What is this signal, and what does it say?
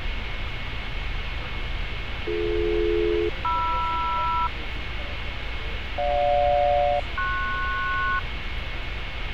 Aircraft SELCAL, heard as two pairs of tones, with radio static, fading and street noise. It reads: BD-MR GJ-PS